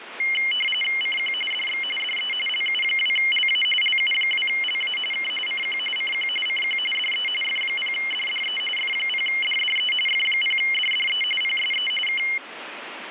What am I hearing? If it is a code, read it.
RTTY (45.45 baud, 850 Hz shift), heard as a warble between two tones, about 2550 Hz centre, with radio static. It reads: CQ DX DE LU2LA LU2LA K CQ CQ CQ DE F0DDE F0DDE F0DDE PSE K